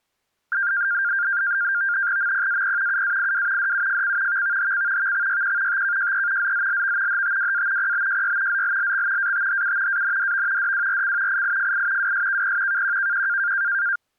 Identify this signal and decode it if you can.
NAVTEX (SITOR-B), 100 baud, 170 Hz shift, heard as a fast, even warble, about 1500 Hz centre. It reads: MPAP UAIW DUFC VVHC VXYQ TKJE ZZLV HTWA PBJY ZLLX ATHU ANDV DWRC IIFI WSKP KQKQ